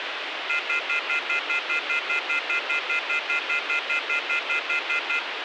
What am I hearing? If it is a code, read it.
Telephone call progress tone (North American plan), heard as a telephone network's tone, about 1400, 2050, 2450, 2600 Hz, 0.1 s on and 0.1 s off, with phone line noise. Off-hook warning tone.